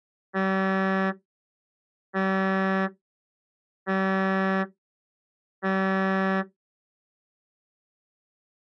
Ship horn signal, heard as a ship's horn, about 190 Hz. 4 short. At sea: a pilot vessel's identity signal in fog.